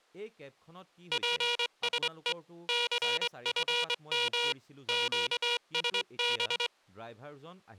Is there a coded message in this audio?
Yes: Morse code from 1.1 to 6.7 s, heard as a buzzer, hand-sent with a straight key, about 22 wpm, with speech in Assamese. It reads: PSE CFM QSB